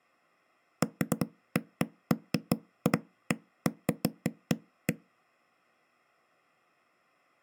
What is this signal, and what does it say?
Irregular knocks on a wall. There is no code.